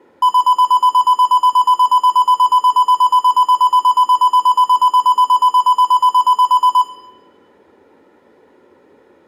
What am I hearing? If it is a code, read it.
Evenly repeated beeps, with room echo. There is no code.